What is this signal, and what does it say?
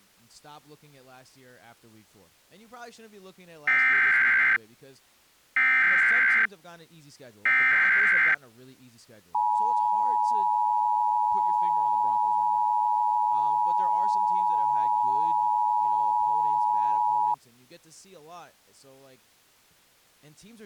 Emergency Alert System (SAME) tones (header bursts, then the 853 and 960 Hz attention tone), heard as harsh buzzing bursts, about 520.83 baud, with speech in English.